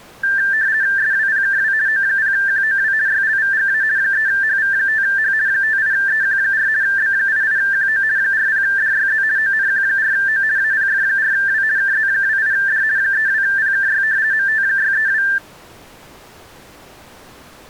RTTY (50 baud, 170 Hz shift), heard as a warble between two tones, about 1700 Hz centre. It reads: SWPKW O0QOW YLVGA 3HV5H 58EQ4 B88QO 40DYZ ONQ4O APF4W KZ28D 32PKY MT632